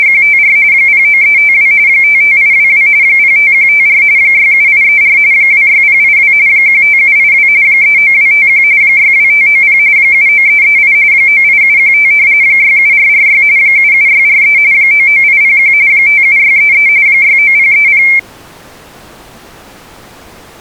RTTY (45.45 baud, 170 Hz shift), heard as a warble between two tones, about 2250 Hz centre. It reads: … 09352 55822 05154 67834 26082 15782 39251 62590 79338 98715 67446 77643 99801 57633 69030